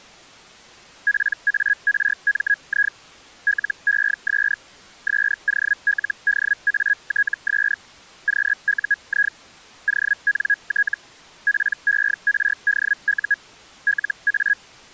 Hellschreiber (Feld-Hell, 122.5 baud), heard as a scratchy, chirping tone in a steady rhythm, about 1650 Hz. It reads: PARMI LES SOLDATS QUI ONT PERDU LA